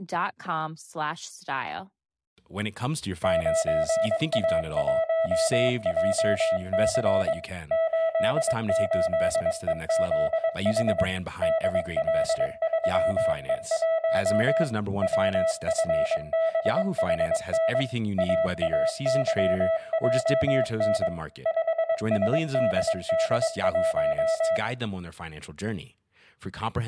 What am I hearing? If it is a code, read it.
Morse code, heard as a keyed tone, machine-sent, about 22 wpm, 650 Hz, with speech in English. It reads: 9A1JC 88EZH DL3E1 WFBHN AAYJN 5SDD1